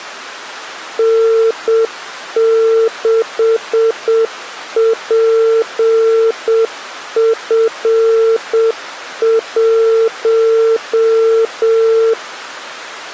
Morse code, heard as a keyed tone, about 7 wpm, 450 Hz. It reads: N6PF1